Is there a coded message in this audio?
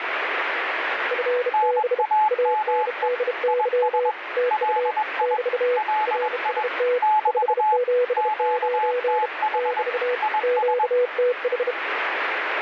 Yes: Morse code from 1.1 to 11.8 s, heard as two keyed tones, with radio static. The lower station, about 32 wpm, 490 Hz: FB ANDY TU <BT> RST 579 <BT> QTH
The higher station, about 21 wpm, 860 Hz: NAME IS LI LI <BT> QTH IS